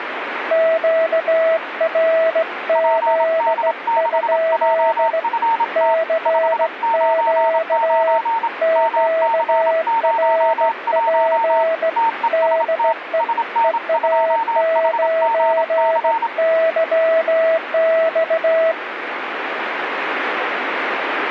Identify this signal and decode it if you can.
Morse code, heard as two keyed tones, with radio static. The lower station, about 17 wpm, 650 Hz: QRZ? CQ QRP DE EA9YX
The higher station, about 27 wpm, 910 Hz: PD6JFT 599 MC01 TEST SN2HGC